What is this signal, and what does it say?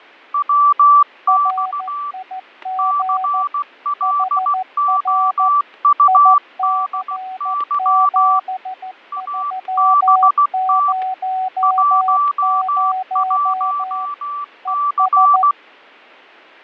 Morse code, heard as two keyed tones, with fading and static crashes. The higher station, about 16 wpm, 1160 Hz: WX CLOUDY ABT 11C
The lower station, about 14 wpm, 750 Hz: RIG HR IC7300 ES